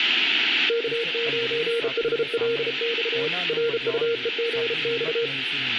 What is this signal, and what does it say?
Morse code, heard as a keyed tone, hand-sent with a bug key, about 33 wpm, 470 Hz, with radio static, room echo and speech in Punjabi. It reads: K9HLX RUEGX